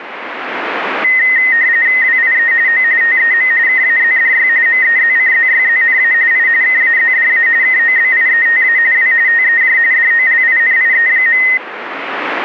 RTTY (45.45 baud, 170 Hz shift), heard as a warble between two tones, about 1950 Hz centre, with radio static. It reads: WIE O TEM KAZDY MEZCZYZNA I KAZDA KOBIETA W TEJ DOLINIE.